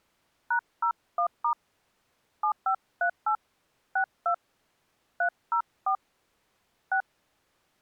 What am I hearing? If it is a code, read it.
DTMF, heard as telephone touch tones, dialled by hand, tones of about 90 ms. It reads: #01* 7538 62 304 6